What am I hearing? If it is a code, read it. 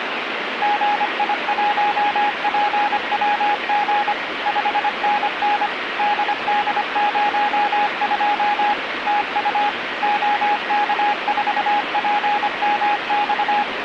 Morse code, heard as a keyed tone, machine-sent, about 25 wpm, 830 Hz, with radio static. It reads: GI1PWG 5NN DD02 TU OK4PMX